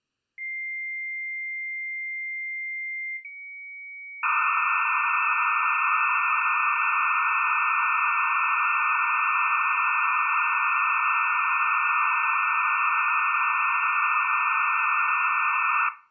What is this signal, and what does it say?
Dial-up modem handshake (low-speed, two carriers), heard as two whistles, then hiss, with room echo.